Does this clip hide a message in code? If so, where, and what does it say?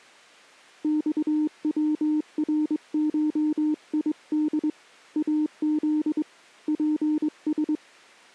Yes: Morse code (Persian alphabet) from 0.8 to 7.8 s, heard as a keyed tone, hand-sent with a straight key, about 22 wpm, 300 Hz. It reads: خورشید از پس